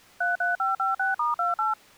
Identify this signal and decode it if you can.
DTMF, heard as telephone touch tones, dialled by machine, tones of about 150 ms. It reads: 33556*28